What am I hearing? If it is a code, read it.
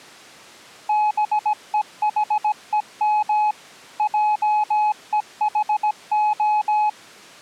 Morse code, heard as a keyed tone, machine-sent, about 17 wpm, 850 Hz. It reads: BEHEM JEHO